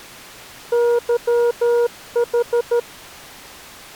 Morse code (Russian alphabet), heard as a keyed tone, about 13 wpm, 480 Hz. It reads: ЫХ